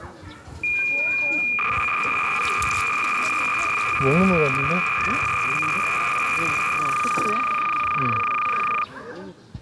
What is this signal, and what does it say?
Cassette data (Kansas City type), 300 baud, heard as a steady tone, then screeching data, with the noise of a residential street.